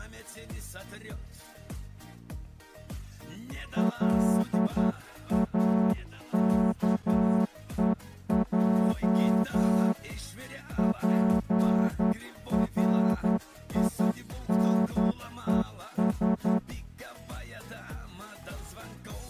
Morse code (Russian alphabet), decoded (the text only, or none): ЛАКЕЙ ПРИНЕС